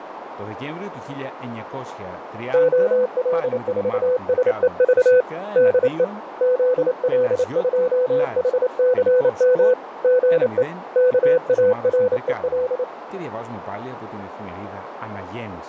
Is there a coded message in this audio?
Yes: Morse code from 2.5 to 12.9 s, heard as a keyed tone, hand-sent with a paddle, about 28 wpm, 500 Hz, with radio static, fading, a narrow filter and speech in Greek. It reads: OL4SEV DE ZL2HCM GE KAREL